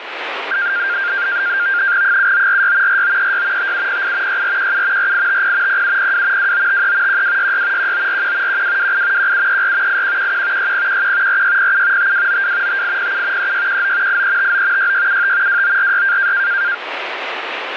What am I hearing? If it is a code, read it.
NAVTEX (SITOR-B), 100 baud, 170 Hz shift, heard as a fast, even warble, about 1500 Hz centre, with radio static. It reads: 7946 4936 5708 6417 4850 0702 2953 1266 1941 1228 1734 8111 6011 4607 5292 5807 3619 8359 6675 2946